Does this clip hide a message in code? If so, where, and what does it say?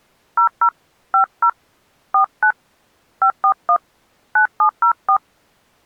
Yes: DTMF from 0.4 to 5.2 s, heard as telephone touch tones, dialled by hand, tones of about 80 ms. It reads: 00 50 49 541 9704